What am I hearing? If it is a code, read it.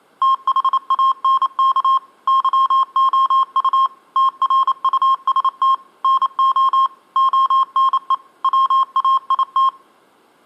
Morse code, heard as electronic beeps, machine-sent, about 28 wpm, 1070 Hz, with room echo. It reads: THANK YOU TRUST NO ONE WAIT